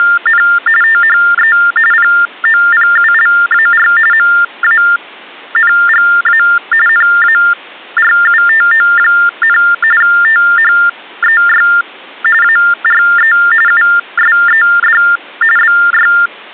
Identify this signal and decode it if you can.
TTY/TDD text telephone tones (45.45 baud Baudot), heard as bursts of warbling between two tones, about 400 Hz shift, 1600 Hz centre. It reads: … THE POPULAR MANGA NARUTO, THEY ARE USED BY